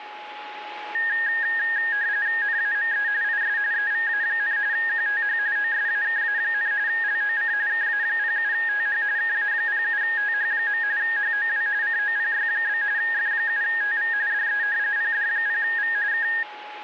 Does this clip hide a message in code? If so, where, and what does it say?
Yes: RTTY (45.45 baud, 170 Hz shift) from 0.9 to 16.4 s, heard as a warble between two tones, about 1750 Hz centre, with a steady whistle near 840 Hz. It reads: NAME IS EVA, QTH OSAKA, LOC KA07TH KA07TH. HOW COPY? F7TV DE PD0V K